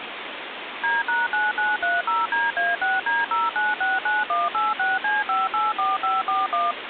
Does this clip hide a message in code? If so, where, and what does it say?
Yes: DTMF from 0.8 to 6.7 s, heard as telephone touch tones, dialled by machine, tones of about 180 ms, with phone line noise. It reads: D#9930DA6D0969186C584541